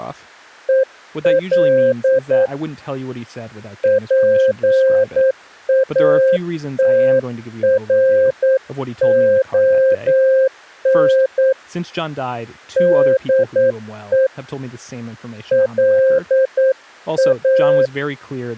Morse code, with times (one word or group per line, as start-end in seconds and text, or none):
0.7-2.5 EL
3.8-11.5 PATRON
12.8-14.3 DE
15.5-17.9 LA